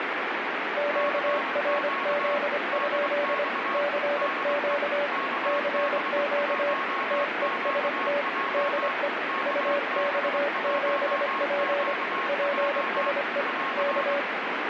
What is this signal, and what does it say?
Morse code, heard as two keyed tones, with heavy radio static. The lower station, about 25 wpm, 580 Hz: QRZ? CQ CQ TEST DE UX7P PSE K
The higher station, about 23 wpm, 1090 Hz: CQ DX DE KB1QJ KB1QJ <AR>